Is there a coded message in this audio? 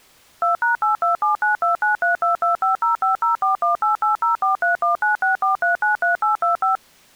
Yes: DTMF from 0.4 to 6.8 s, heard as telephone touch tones, dialled by machine, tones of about 130 ms. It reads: 2#827929322505041880431964393825